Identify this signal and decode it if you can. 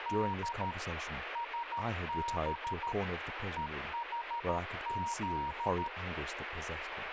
Morse code, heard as a keyed tone, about 13 wpm, 940 Hz, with radio static and speech in English. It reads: D SB EHZ